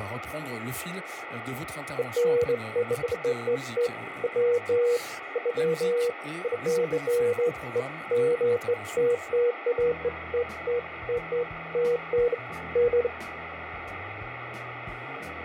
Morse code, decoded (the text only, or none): none